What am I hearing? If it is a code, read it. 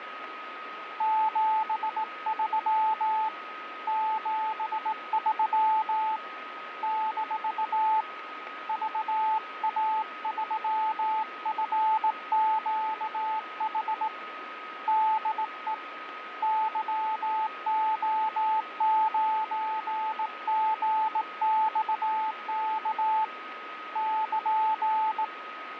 Morse code, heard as a keyed tone, hand-sent with a straight key, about 18 wpm, 870 Hz, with radio static and a steady whistle near 1260 Hz. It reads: 73 73 - VA3FQH DE YO9GXK <KN>